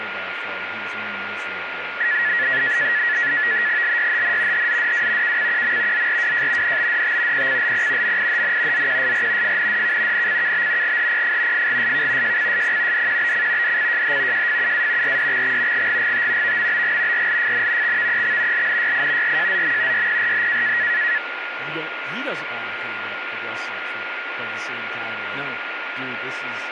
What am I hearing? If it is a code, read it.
NAVTEX (SITOR-B), 100 baud, 170 Hz shift, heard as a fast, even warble, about 1800 Hz centre, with radio static, a steady whistle near 1420 Hz and speech in English. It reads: LYHN HZDW KCQM ZRWJ NBDT PCLP MIHN ZQSR FNDK NCKB GHPF FGSK JCSP DQBC DCJH JFUA RDXX GGGT VMBG RLFN XVEX LNYI RJZM YPRH